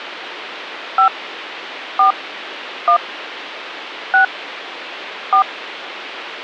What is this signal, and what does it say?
DTMF, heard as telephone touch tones, dialled by hand, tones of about 100 ms, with phone line noise. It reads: 5 4 1 6 4